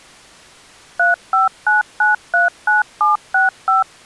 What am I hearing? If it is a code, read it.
DTMF, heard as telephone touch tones, dialled by machine, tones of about 150 ms. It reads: 359939765